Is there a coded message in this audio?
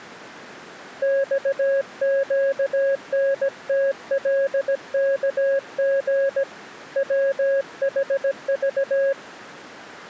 Yes: Morse code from 1.0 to 9.2 s, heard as a keyed tone, hand-sent with a paddle, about 17 wpm, 550 Hz. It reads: XQNTLKG WHV